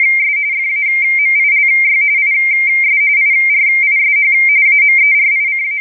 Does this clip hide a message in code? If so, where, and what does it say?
Yes: RTTY (45.45 baud, 170 Hz shift) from 0.0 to 5.8 s, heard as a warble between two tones, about 2200 Hz centre. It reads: … FAMILY IS IRISH …